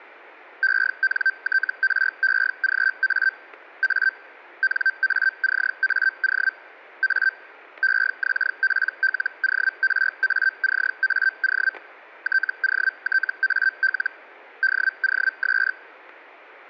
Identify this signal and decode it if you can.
Hellschreiber (Feld-Hell, 122.5 baud), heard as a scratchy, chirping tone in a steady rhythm, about 1550 Hz, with static crashes. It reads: ENTREGA A NACAO A EXPLORACAO TOTAL DOS